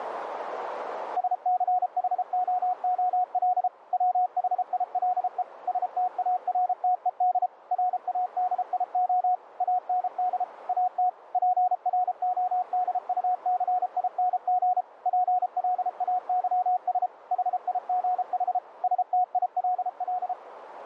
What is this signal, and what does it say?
Morse code, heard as a keyed tone, machine-sent, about 33 wpm, 730 Hz, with radio static and a narrow filter. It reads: SCHOOL WHILE STARTED RADIO AND AT PRODUCING PLAYS HIGH STILL